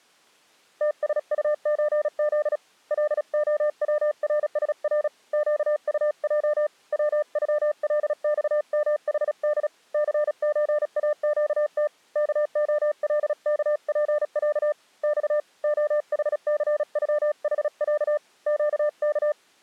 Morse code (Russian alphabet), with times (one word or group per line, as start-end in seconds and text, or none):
0.8-2.6 ТСУЧЗ
2.9-5.1 ЛОВРСР
5.3-6.7 ЩУЙ
6.9-9.7 ВЮЛЬМХД
9.9-11.9 ЦЧАЩТ
12.2-14.7 КОЛКПЯ
15.0-15.4 Ь
15.6-18.2 ОХЦЮХЯ
18.5-19.3 ЩК